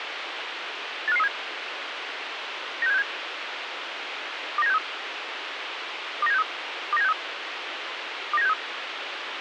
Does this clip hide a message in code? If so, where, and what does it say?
Yes: five-tone selective call (EEA) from 1.1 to 8.5 s, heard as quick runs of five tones, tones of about 40 ms, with radio hiss. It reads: 85537 96767 29763 29763 29763 29763